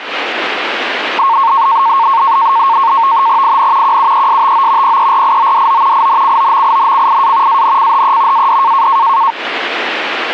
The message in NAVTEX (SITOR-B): IN QUESTO PERIODO INCOMINCIA ANCHE AD

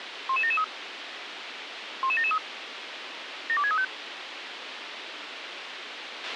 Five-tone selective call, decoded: 11773 11773 72635

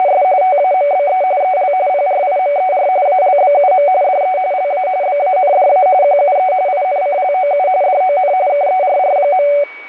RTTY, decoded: … TAMBE EL PRIMER ALBUM DE LA BANDA QUE INCLOU DON KERR.

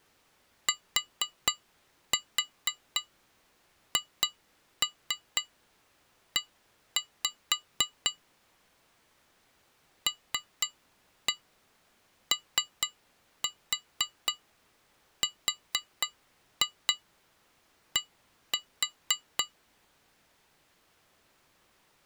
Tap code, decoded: THE LORD

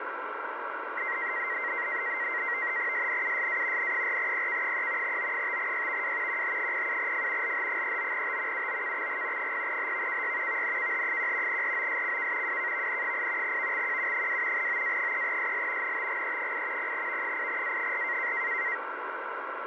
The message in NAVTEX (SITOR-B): SNUSA N4PK3 O5YVW QH07F LH39T UOKXG 0HVKY VNKH1 ROSCK WKVN8 VXQU2 OA3SL NTGE8 0V8A4

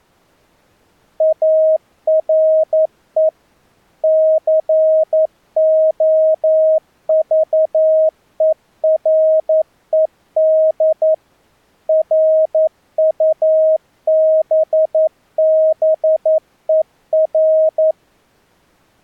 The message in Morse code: ARE COVERED RUBBER

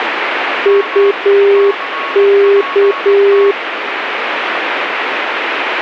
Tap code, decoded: none

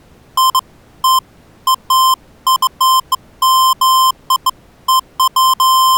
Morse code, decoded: none

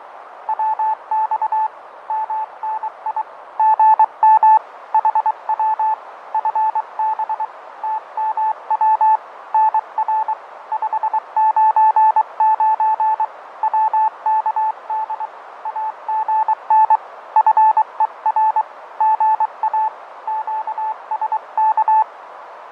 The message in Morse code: WX MNI GM HW FB TMW NR 599 WKD AGN FER GA QSK

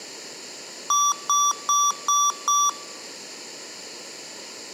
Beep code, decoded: 5 short

